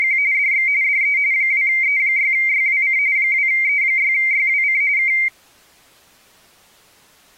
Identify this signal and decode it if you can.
RTTY (45.45 baud, 170 Hz shift), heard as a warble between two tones, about 2200 Hz centre. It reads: … DX DE 2E6YWC 2E6YWC K